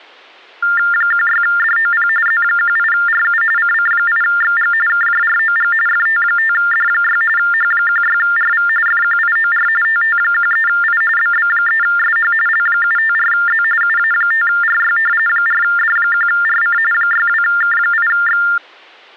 TTY/TDD text telephone tones (45.45 baud Baudot), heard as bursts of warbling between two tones, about 400 Hz shift, 1600 Hz centre. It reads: 16DOP Z18RU CC8XG KJROG FT5D6 H16RV FQIOR TT13I BB3SH L754Z UA5RY 4D1RC 62K8X